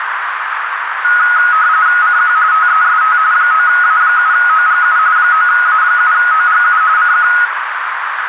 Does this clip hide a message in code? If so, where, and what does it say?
Yes: RTTY (45.45 baud, 170 Hz shift) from 1.0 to 7.5 s, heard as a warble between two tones, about 1360 Hz centre, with radio static and a narrow filter. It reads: CQ TEST 9A7OGU 9A7OGU CQ